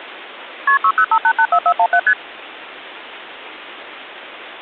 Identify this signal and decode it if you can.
Multi-frequency trunk signalling (R1, as on North American trunks), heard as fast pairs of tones, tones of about 70 ms. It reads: KP 605884417 ST